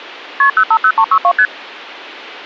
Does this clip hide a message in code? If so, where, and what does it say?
Yes: multi-frequency trunk signalling (R1, as on North American trunks) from 0.4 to 1.5 s, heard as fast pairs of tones, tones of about 70 ms. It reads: KP 050362 ST